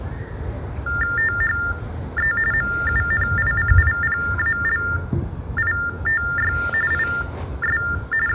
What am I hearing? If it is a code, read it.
TTY/TDD text telephone tones (45.45 baud Baudot), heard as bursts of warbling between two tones, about 400 Hz shift, 1600 Hz centre, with the noise of a park. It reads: THE MUNICIPALITY IS …